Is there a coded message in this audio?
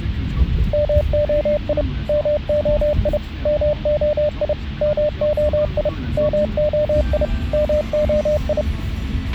Yes: Morse code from 0.7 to 8.7 s, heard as a keyed tone, machine-sent, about 30 wpm, 600 Hz, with a squelch burst at the end and the noise inside a car. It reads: MOI MOI MOI MOI MOI MOI